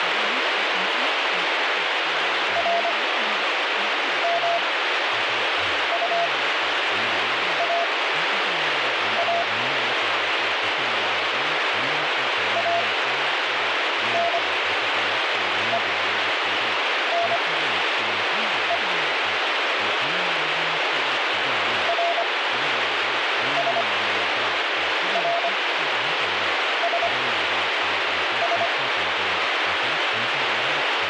Morse code, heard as a keyed tone, machine-sent, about 25 wpm, spaced as for 6 wpm, 680 Hz, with radio static and speech in Korean. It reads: RMUAA ANENE RSRSS